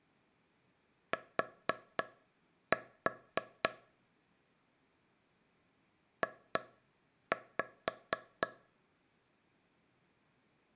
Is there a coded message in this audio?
Yes: tap code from 1.1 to 8.5 s, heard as taps on a table, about 3 knocks a second. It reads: T J